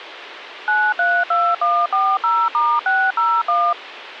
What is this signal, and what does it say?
DTMF, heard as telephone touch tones, dialled by machine, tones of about 250 ms, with phone line noise. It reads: 932140*601